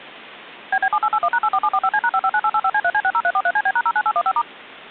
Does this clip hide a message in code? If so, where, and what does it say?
Yes: DTMF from 0.7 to 4.4 s, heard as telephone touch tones, dialled by machine, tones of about 60 ms. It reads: BB7881#84745C#559885C3C60343CB#09815*